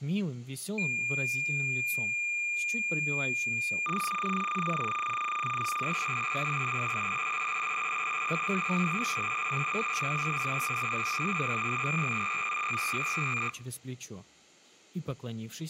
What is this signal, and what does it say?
Cassette data (Kansas City type), 300 baud, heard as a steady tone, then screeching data.